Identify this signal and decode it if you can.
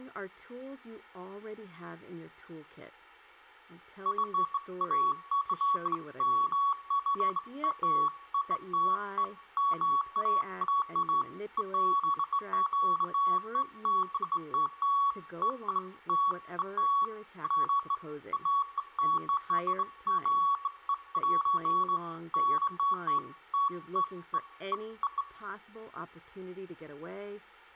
Beeps of irregular length, with room echo and speech in English. There is no code.